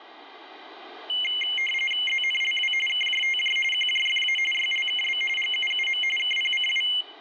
RTTY (45.45 baud, 850 Hz shift), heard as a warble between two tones, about 2550 Hz centre. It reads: ZNLW KJTJ QJFA YLKB GUUM KPCW